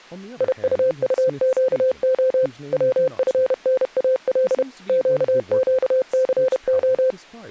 Morse code, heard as a keyed tone, machine-sent, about 31 wpm, 520 Hz, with speech in English. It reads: IUUQO WFNAL QQCO